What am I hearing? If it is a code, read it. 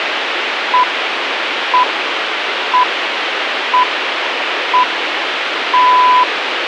Radio time signal (six pips, as the Greenwich Time Signal), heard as pips, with radio hiss.